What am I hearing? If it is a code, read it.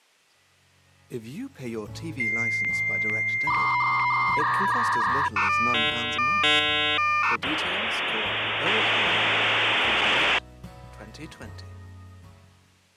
Dial-up modem handshake (V.34 or later), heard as a whistle, warbles, then hiss.